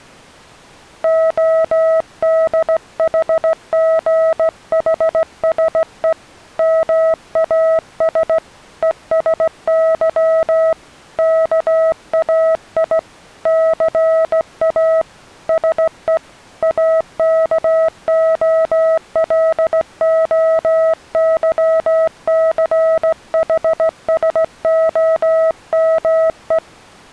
Morse code (Greek alphabet), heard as a keyed tone, hand-sent with a straight key, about 16 wpm, 650 Hz. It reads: ΟΔΗΓΗΣΕ ΜΑΣ ΕΣΥ ΚΑΙ ΘΑ ΣΕ ΑΚΟΛΟΥΘΗΣΟΜΕ